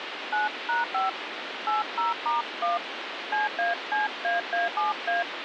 DTMF, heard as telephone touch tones, dialled by hand, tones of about 160 ms, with phone line noise. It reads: 9#5 80*1 CACAA7A